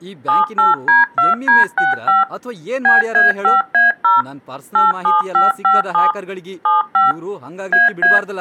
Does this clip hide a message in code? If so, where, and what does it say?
Yes: DTMF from 0.3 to 8.2 s, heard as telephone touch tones, dialled by machine, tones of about 160 ms, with speech in Kannada. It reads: 78D2D65 BA5A0 87557 75 AA